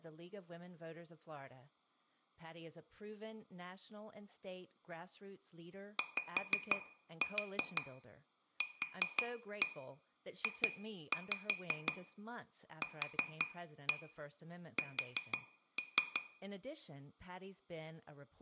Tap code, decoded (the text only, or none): YQJQS